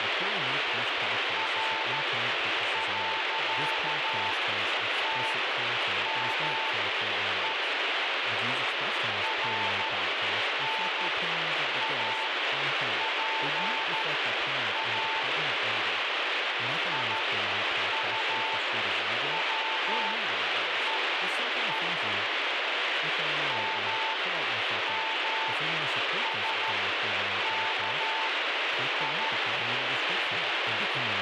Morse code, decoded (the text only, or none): R.TME RNAPA IUWEE MMSKI